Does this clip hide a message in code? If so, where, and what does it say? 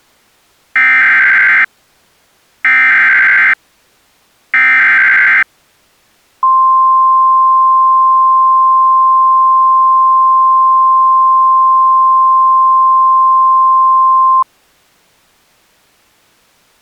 Yes: Emergency Alert System (SAME) tones (header bursts, then the 1050 Hz attention tone) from 0.8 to 14.4 s, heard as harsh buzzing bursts, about 520.83 baud.